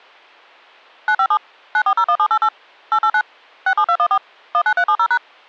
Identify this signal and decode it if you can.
DTMF, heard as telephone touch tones, dialled by machine, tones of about 70 ms. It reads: 957 9401788 889 67214 19370#